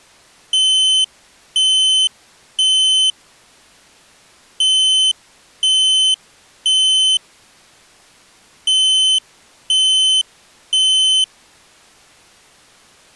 Alarm pattern, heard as an alarm's beeps, played three times, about 3050 Hz. Temporal three. Smoke or fire, evacuate.